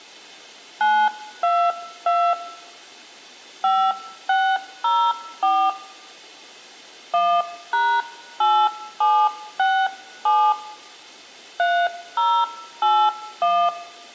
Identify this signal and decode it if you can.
DTMF, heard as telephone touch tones, dialled by hand, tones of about 270 ms, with room echo. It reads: 922 5604 1#8767 3081